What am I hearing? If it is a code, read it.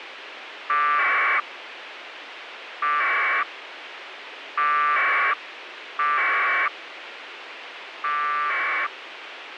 Packet radio (AX.25, as in APRS), 1200 baud, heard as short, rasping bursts, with radio hiss.